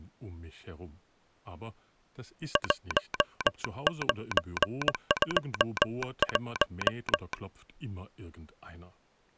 Morse code, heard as a telegraph sounder, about 19 wpm, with speech in German. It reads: 1921